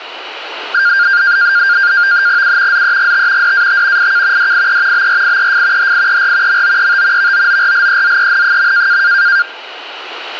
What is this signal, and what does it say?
NAVTEX (SITOR-B), 100 baud, 170 Hz shift, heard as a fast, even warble, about 1500 Hz centre, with radio static. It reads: U ZEGT DAT IK DIE BRIEF HIER MOET VOORLEZEN.